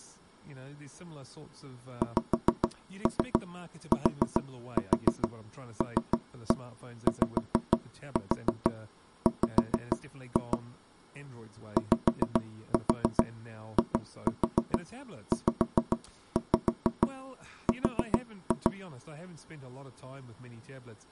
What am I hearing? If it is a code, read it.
Tap code, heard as knocks on wood, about 6 knocks a second, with speech in English. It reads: XTLYW YIZR